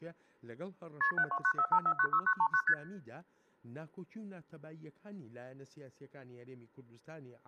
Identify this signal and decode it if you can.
Multi-frequency trunk signalling (R1, as on North American trunks), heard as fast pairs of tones, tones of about 70 ms. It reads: KP 72945496939 ST